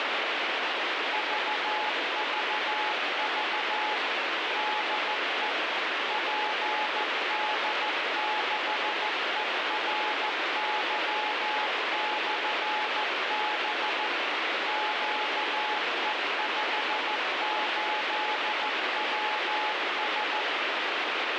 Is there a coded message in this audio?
Yes: Morse code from 1.1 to 20.5 s, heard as a keyed tone, machine-sent, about 14 wpm, 850 Hz, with heavy radio static. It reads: VVV DE PD6ERY/B QE58WS